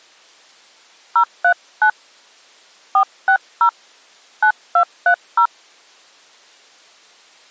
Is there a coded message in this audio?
Yes: DTMF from 1.2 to 5.5 s, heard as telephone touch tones, dialled by hand, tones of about 80 ms. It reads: 039 460 9230